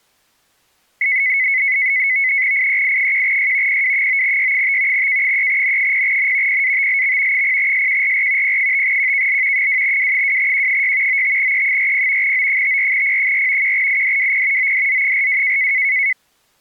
NAVTEX (SITOR-B), 100 baud, 170 Hz shift, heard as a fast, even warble, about 2100 Hz centre. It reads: IEI1Y PW9Y5 K3N0N PATLX 0SQRR P5QKL 2W2Q6 95E40 O54P4 1IDWP ODZ42